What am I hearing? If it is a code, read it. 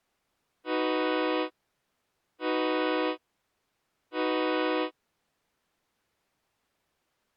Train horn signal, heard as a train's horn. 3 short. On North American railways: when stopped, the train will back up.